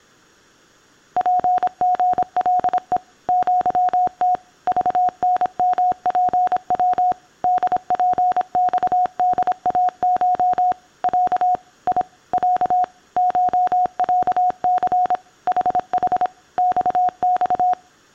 Morse code (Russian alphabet), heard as a keyed tone, machine-sent, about 26 wpm, 730 Hz. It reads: ПГЛЕ ЪТ ЖНМПВ ДПЬДАШ Я И Я ШЯЦ ХХ ЬЬ